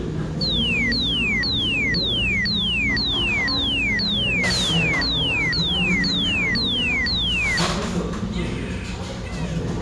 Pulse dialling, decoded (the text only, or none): none